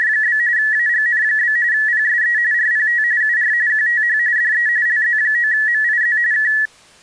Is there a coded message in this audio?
Yes: RTTY (45.45 baud, 170 Hz shift) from 0.0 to 6.7 s, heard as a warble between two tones, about 1800 Hz centre. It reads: … AGN? PSE RPT UR QTH DE LZ9MIZ K